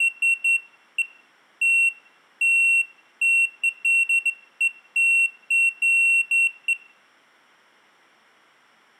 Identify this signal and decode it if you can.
Beeps of irregular length, with room echo. There is no code.